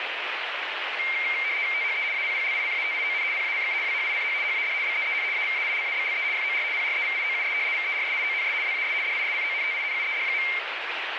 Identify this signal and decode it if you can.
RTTY (75 baud, 170 Hz shift), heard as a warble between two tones, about 2200 Hz centre, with radio static. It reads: THE APPLICATION PACK WHICH HAD BEEN AVAILABLE FOR PREVIOUS VERSIONS WAS DISCONTINUED.